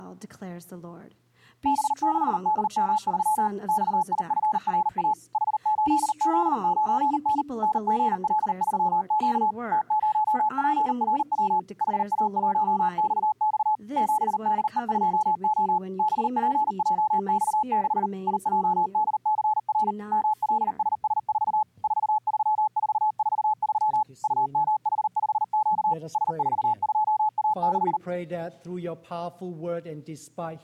Morse code, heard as a keyed tone, machine-sent, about 39 wpm, 860 Hz. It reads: B6DM3 XIFRA H8Z9N NGL3Q T0PRW HA1XX 7DE2O BPJX6 IJDCR MLSS4 43443 UMH5Q S42A6